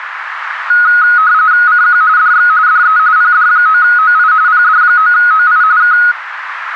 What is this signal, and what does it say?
RTTY (45.45 baud, 170 Hz shift), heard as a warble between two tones, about 1360 Hz centre, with radio static and a narrow filter. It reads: CQ DX DE PD9OI PD9OI K